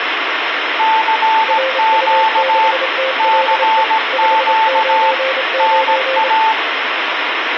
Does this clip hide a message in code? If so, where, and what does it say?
Yes: Morse code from 0.7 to 6.6 s, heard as two keyed tones, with radio static. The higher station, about 17 wpm, 880 Hz: CQ CQ NA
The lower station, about 27 wpm, 530 Hz: RU6TLE 599